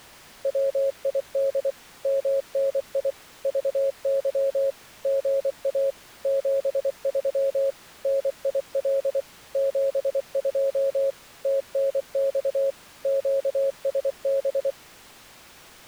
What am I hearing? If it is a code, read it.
Morse code, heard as a keyed tone, machine-sent, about 24 wpm, 550 Hz. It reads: WID MNI VY GA 73 NIL 72 TNX QSB